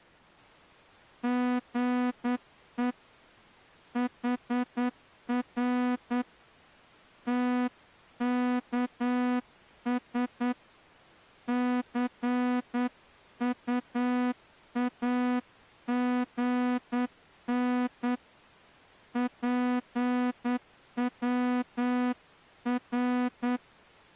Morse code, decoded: GE HR TKS CUAGN PWR

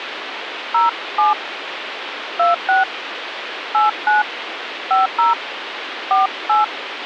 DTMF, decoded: 07 26 89 50 48

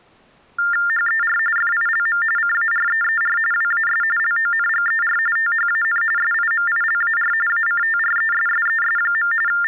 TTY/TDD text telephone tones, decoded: HER FILM CAREER WAS LONGER THAN SIMILAR ACTRESSES. …

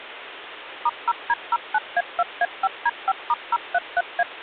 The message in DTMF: *0D09A2A5D5*033A

